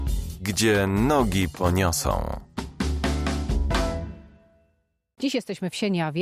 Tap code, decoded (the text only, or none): none